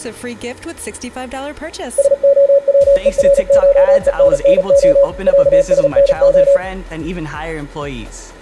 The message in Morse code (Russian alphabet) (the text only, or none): СОВЕРШЕННО ЯСНО